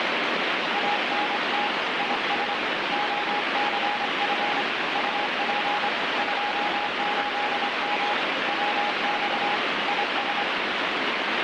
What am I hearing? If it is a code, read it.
Morse code, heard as a keyed tone, hand-sent with a straight key, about 25 wpm, 830 Hz, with heavy radio static. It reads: ANT IS OCF UP 28M WX IS